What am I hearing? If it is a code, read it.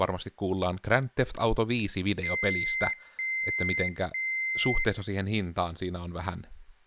Beep code, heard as beeps from a small speaker, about 2100 Hz, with room echo and speech in Finnish. 3 long. In IBM BIOS tables: keyboard card error.